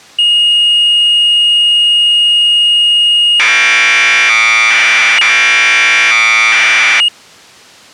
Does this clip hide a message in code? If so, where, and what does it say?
Yes: Commodore tape loading (standard loader) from 0.2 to 7.1 s, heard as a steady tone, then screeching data.